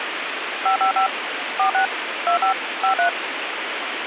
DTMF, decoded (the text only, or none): 555 46 25 53